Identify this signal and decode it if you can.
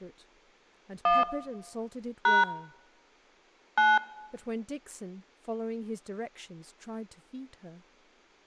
DTMF, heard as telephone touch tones, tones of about 180 ms, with speech in English. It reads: 1 # 9